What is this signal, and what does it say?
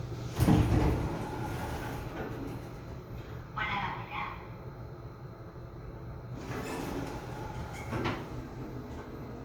The noise inside a lift. There is no code.